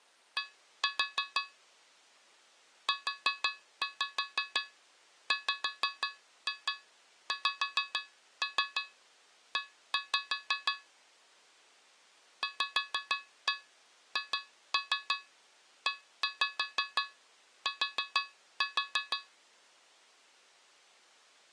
Tap code, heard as taps on a metal pipe, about 6 knocks a second. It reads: D UWXE VHET